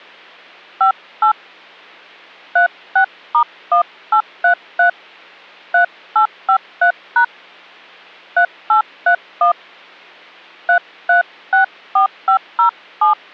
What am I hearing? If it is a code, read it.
DTMF, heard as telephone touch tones, dialled by hand, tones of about 100 ms. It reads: 58 36*1833 3853# 3831 3364507